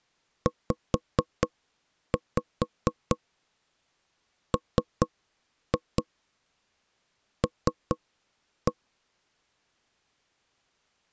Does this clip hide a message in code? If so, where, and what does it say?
Yes: tap code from 0.5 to 8.7 s, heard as knocks on wood, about 4 knocks a second. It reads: ZML